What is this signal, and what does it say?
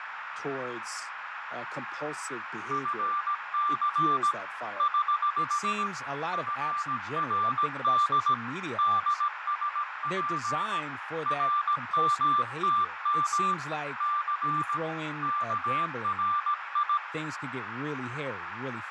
Morse code, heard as a keyed tone, hand-sent with a paddle, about 17 wpm, 1180 Hz, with radio static, fading, a narrow filter and speech in English. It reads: FC <HH> FRD DSP RMTM C KRI